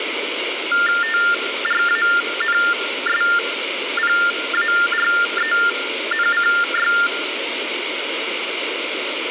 TTY/TDD text telephone tones (45.45 baud Baudot), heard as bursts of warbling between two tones, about 400 Hz shift, 1600 Hz centre, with phone line noise. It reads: TRANSPARENCY